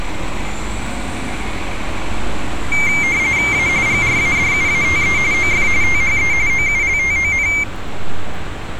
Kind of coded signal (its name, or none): RTTY